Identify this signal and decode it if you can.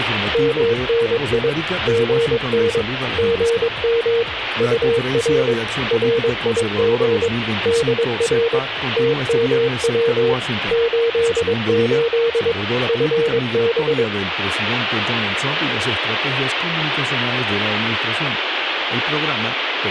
Morse code, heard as a keyed tone, machine-sent, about 22 wpm, 460 Hz, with radio static. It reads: MNI GN GM UR RIG DR TMW 88 FB